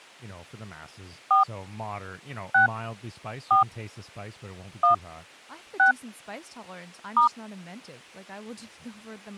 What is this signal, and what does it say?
DTMF, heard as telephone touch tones, dialled by hand, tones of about 120 ms, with speech in English. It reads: 4 6 4 1 6 *